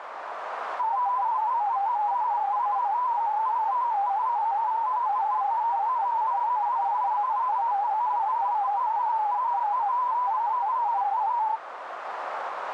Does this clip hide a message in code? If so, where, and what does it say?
Yes: multi-tone FSK (Olivia or MFSK type), about 250 Hz wide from 0.8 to 11.6 s, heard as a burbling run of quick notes, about 31.25 baud, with radio static and a narrow filter.